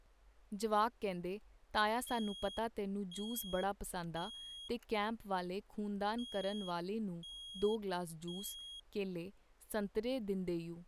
Alarm pattern, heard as an alarm's beeps, played twice, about 3300 Hz, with speech in Punjabi. Temporal three. Smoke or fire, evacuate.